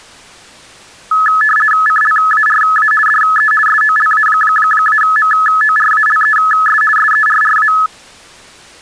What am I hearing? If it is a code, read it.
RTTY (50 baud, 450 Hz shift), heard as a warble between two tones, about 1500 Hz centre. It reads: CLARA DE SOLA-MORALES SERRA